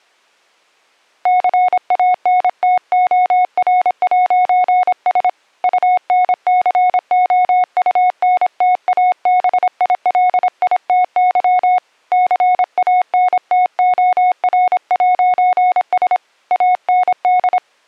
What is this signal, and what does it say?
Morse code, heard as a keyed tone, hand-sent with a paddle, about 26 wpm, 730 Hz. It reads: CANTOR'S UNCOUNTABILITY CANTOR'S AND